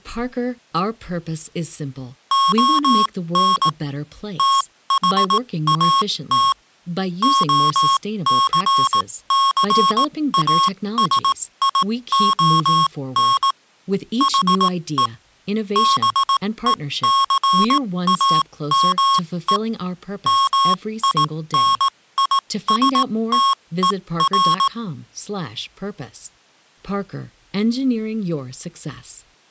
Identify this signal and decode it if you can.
Morse code, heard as electronic beeps, machine-sent, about 18 wpm, spaced as for 15 wpm, 1090 Hz, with speech in English. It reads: ON THAT OCCASION HE BECAME MINISTER